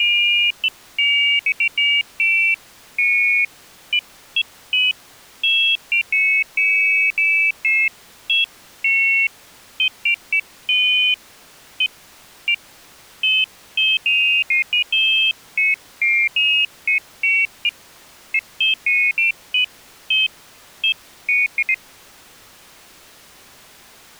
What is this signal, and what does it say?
Pairs of high tones at irregular times. There is no code.